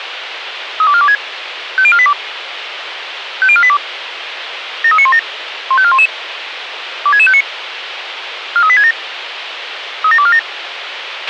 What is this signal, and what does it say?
Five-tone selective call (ZVEI), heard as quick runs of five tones, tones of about 70 ms, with radio hiss and a squelch burst at the end. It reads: 32426 50482 50482 73917 15411 26659 43867 37247